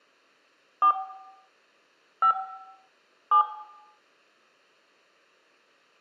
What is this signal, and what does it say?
DTMF, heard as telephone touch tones, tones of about 90 ms, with room echo. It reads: 4 5 7